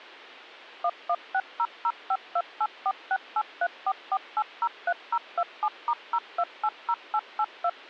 DTMF, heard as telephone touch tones, dialled by machine, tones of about 60 ms. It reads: 11600528468344803027*0280882